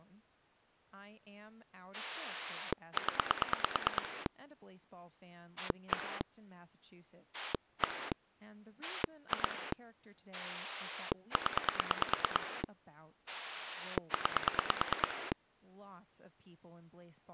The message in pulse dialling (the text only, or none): 0 1 1 2 0 9